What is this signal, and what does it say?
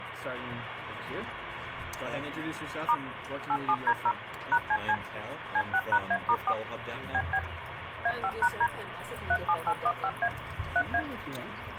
DTMF, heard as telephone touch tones, dialled by machine, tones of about 60 ms, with phone line noise. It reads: * 87D0 #CC C6#A*4 BB A5#D 37815A 3A